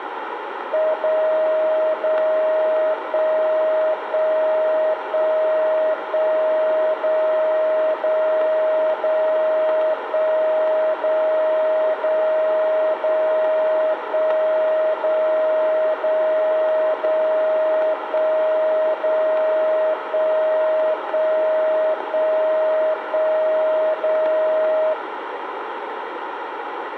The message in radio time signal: 0 0 1 1 1 1 0 0 0 1 0 0 0 1 0 0 0 1 0 1 1 1 1 0

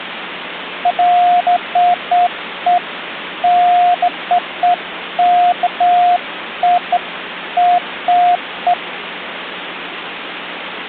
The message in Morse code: none

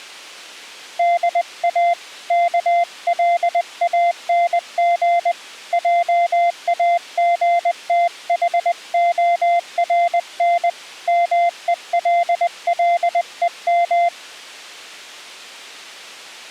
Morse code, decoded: DA KLANG JAGTHORN MELLEM

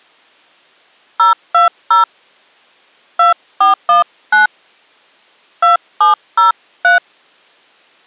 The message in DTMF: 020 2419 2703

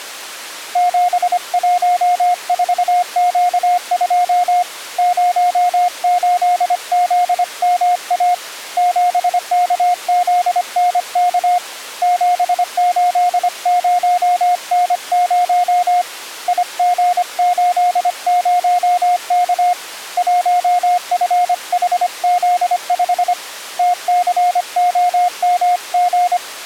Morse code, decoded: 714Q2 08ZMA 7KZNK 780N0 IG80K 1FHZ5 TCOMG

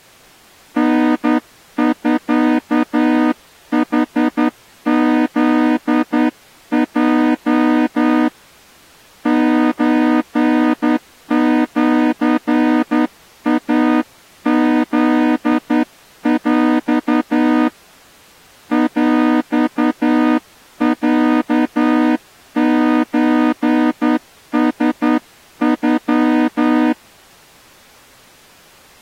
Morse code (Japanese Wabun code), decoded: タミヌフヲ ソシイフヰ ヰロソラノ

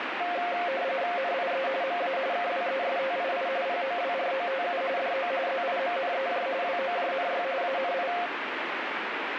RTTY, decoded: NIE MA KWESTII POWROTU DO ZIMNEJ WOJNY ANI

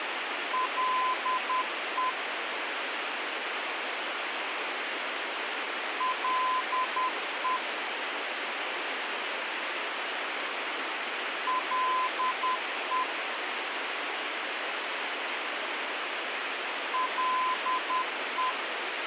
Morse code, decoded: LE LE LE LE

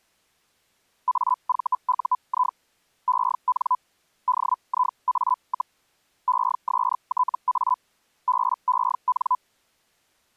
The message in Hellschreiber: AVUI EN DIA, ESTA BEN

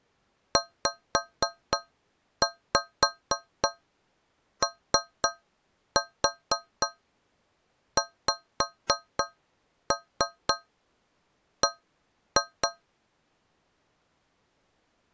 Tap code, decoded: ZOXB

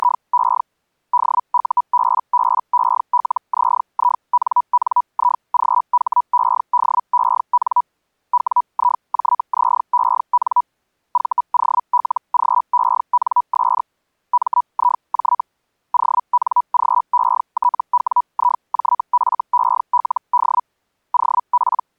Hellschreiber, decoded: … DUBBELZINNIGHEDEN WIJZEN VOLGENS MIJ ONGETWIJFELD OP

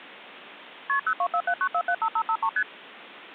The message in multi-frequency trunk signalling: KP 02479475553 ST

